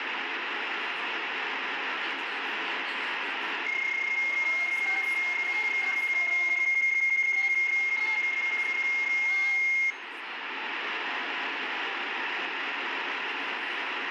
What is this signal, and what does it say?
PSK31 (31.25 baud), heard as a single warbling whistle, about 2150 Hz, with radio static and room echo.